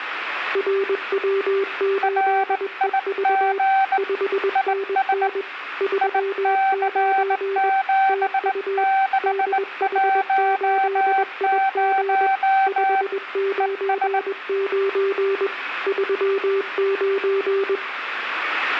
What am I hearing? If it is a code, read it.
Morse code, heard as two keyed tones. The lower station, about 21 wpm, 390 Hz: RW8EV 5NN 39 TU DH8IG 599 39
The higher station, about 19 wpm, 770 Hz: RIG IS IC7610 ES